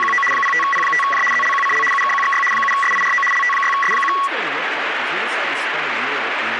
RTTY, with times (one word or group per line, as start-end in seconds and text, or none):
0.0-0.2 …
0.3-1.2 05P5J
1.3-1.8 ZLQCL
1.9-2.4 UKQXY
2.5-3.2 7SIRO
3.3-4.1 LT6S1